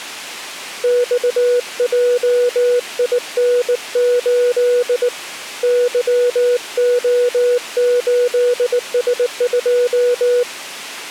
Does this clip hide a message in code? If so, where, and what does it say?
Yes: Morse code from 0.8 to 10.5 s, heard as a keyed tone, hand-sent with a bug key, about 19 wpm, 490 Hz. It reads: XJIN8 YO8S2